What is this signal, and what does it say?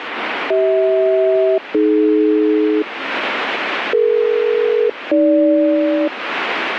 Aircraft SELCAL, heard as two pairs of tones, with radio static. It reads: CH-AD DE-AG